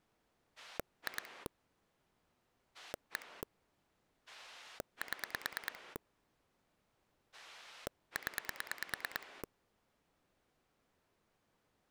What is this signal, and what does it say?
Pulse dialling, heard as a rotary dial, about 9 pulses a second. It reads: 2 1 7 0